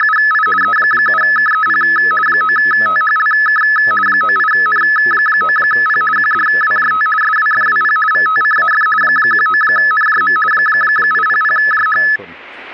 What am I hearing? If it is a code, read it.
RTTY (50 baud, 450 Hz shift), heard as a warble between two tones, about 1500 Hz centre. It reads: … E7KEP 9THLK 98N9P QDWJT SWFWP VTCAF 19NJM 800JH